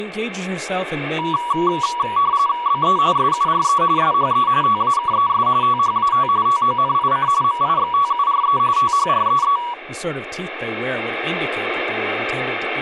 RTTY (45.45 baud, 170 Hz shift), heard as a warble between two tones, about 1050 Hz centre, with speech in English. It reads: BE SURE SHE TAKES THAT TONIC MIXTURE THREE